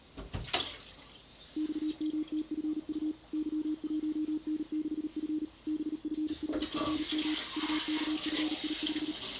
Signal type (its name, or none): Morse code